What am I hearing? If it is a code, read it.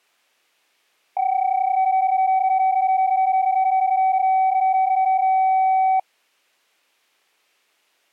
PSK31 (31.25 baud), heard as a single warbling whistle, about 760 Hz.